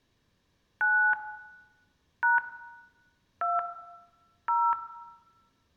DTMF, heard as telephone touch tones, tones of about 240 ms, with room echo. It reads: 9 # 2 0